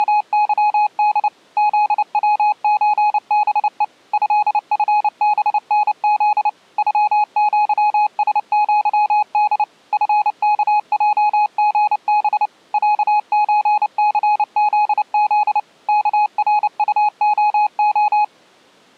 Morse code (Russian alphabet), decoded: … ЗВЧБЕ ЭФБНЗ ЮЪСЪД ФКЙГБ ЯЧЦЗЗ КРУОО

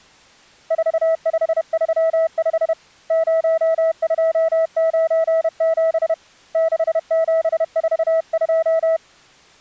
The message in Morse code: 4535 0297 6742

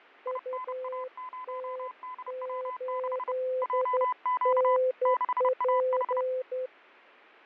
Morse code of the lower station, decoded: UT8NP

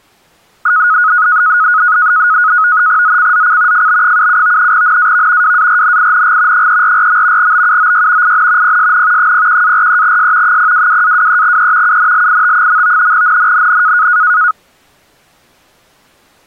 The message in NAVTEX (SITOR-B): ZCZC FB77 NAV WARNING 344. BUOY IN PSN 01-43S 022-23E UNLIT. NNNN

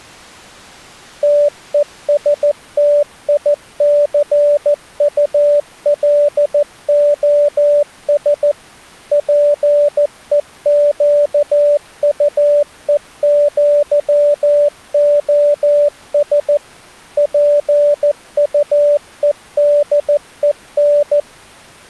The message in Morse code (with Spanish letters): TESTICULOS PEQUEÑOS PUEDEN

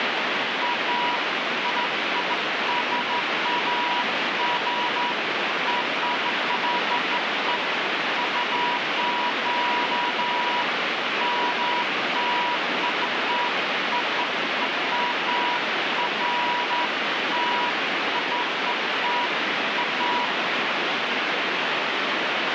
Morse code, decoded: none

